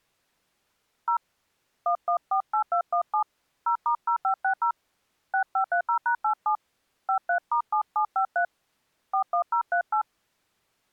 DTMF, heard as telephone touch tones, dialled by hand, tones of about 90 ms. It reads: 0 1148217 0*0560 6530#87 53*7753 41038